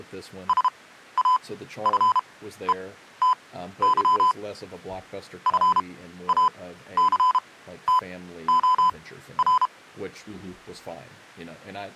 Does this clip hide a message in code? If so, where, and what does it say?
Yes: Morse code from 0.4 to 9.7 s, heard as electronic beeps, machine-sent, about 32 wpm, spaced as for 14 wpm, 1010 Hz, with speech in English. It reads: SAFETY FACTOR